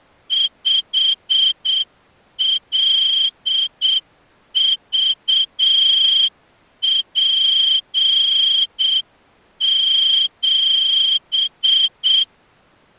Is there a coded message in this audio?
Yes: Morse code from 0.2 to 12.3 s, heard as a whistle, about 7 wpm. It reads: 5LVP7